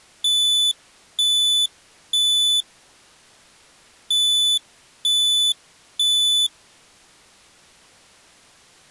Alarm pattern, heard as an alarm's beeps, played twice, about 3500 Hz. Temporal three. Smoke or fire, evacuate.